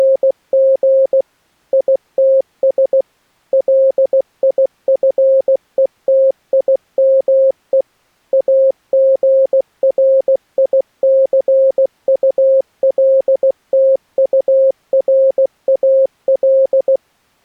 Morse code, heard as a keyed tone, machine-sent, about 16 wpm, 540 Hz. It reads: … ITS LIFETIME AGRICULTURAL